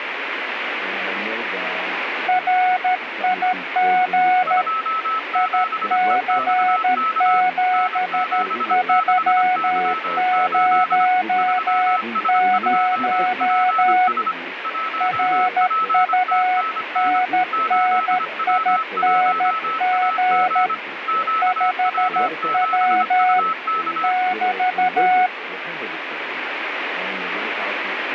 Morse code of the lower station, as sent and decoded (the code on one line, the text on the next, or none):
.-. .. --. / .. -.-. --... ...-- ----- ----- / .-. ..- -. -. .. -. --. / ..... .-- / -...-
RIG IC7300 RUNNING 5W <BT>